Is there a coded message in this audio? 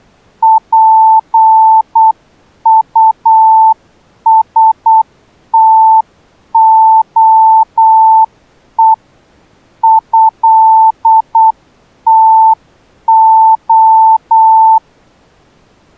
Yes: Morse code (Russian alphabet) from 0.4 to 14.8 s, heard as a keyed tone, hand-sent with a paddle, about 8 wpm, 890 Hz. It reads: ПУСТОЕ ЭТО